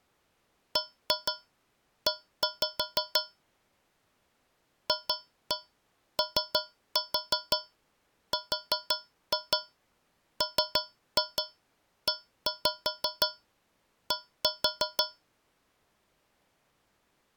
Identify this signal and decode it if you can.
Tap code, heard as taps on a metal pipe, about 6 knocks a second. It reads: BE FORMED